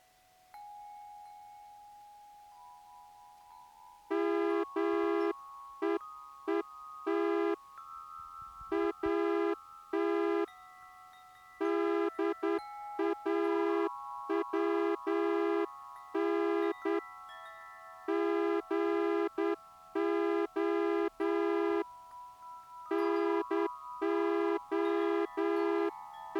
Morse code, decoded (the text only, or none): MEET AT DAWN GO …